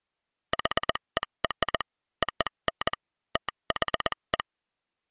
Morse code (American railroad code), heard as a telegraph sounder, machine-sent. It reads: HER ON THE